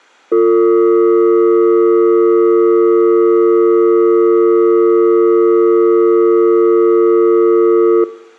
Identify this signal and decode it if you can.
Telephone call progress tone (North American or UK plan), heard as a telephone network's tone, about 350, 450 Hz. Dial tone.